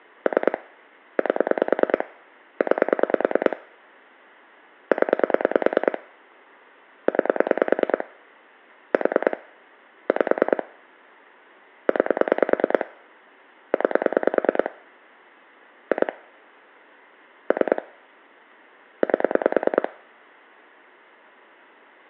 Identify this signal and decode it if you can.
Pulse dialling, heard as clicks on a phone line, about 9 pulses a second, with room echo. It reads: 3 8 9 0 9 4 5 9 9 2 3 8